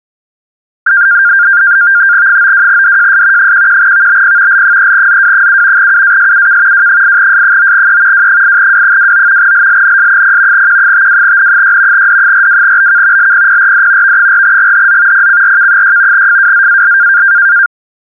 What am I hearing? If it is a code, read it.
NAVTEX (SITOR-B), 100 baud, 170 Hz shift, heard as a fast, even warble, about 1500 Hz centre. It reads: 92DJS 11VBP L3ZW7 UASUK W8S9E W8W29 LLNS0 Q52N6 D42BK LPPRD V4GHZ PCRK6 FWZAL